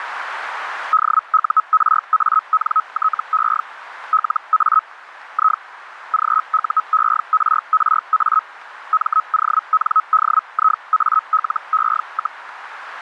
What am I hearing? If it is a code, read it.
Hellschreiber (Feld-Hell, 122.5 baud), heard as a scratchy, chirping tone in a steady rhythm, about 1280 Hz, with radio static. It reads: DURANTE LA I GUERRA MONDIALE,